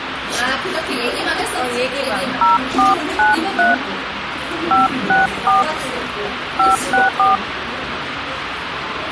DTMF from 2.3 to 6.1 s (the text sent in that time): 0493 564